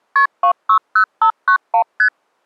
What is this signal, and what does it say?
Multi-frequency trunk signalling (R1, as on North American trunks), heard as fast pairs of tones, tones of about 90 ms. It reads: KP 260591 ST